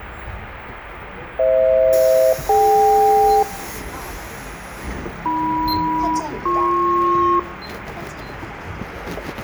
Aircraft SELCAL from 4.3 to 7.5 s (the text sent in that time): AM-BP